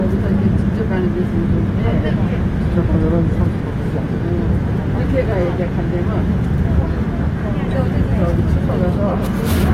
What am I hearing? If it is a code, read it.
The noise inside a subway train. There is no code.